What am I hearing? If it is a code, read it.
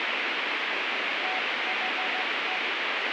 Morse code (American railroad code), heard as a keyed tone, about 750 Hz, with heavy radio static. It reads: THE